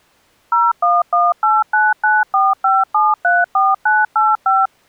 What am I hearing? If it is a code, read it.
DTMF, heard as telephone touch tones, dialled by machine, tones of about 200 ms. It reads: 01189945734985